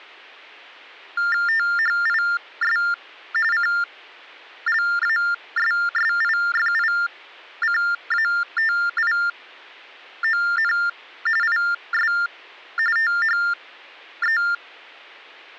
TTY/TDD text telephone tones (45.45 baud Baudot), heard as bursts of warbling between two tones, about 400 Hz shift, 1600 Hz centre. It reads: THIS CLASSIFICATION IS THE